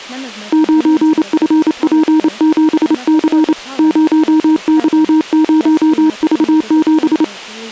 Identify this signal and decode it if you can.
Morse code, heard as a keyed tone, hand-sent with a paddle, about 28 wpm, 310 Hz, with speech in English. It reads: 9FP7C 0Y0V7